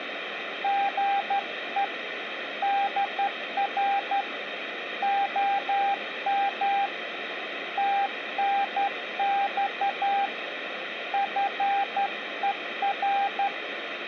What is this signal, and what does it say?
Morse code, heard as a keyed tone, hand-sent with a straight key, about 12 wpm, 800 Hz, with radio static. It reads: GE DR OM TNX FER